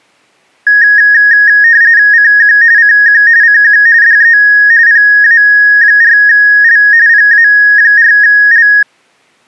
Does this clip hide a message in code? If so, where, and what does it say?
Yes: RTTY (45.45 baud, 170 Hz shift) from 0.7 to 8.8 s, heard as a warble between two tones, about 1750 Hz centre. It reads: CQ CQ CQ DE PA4L PA4L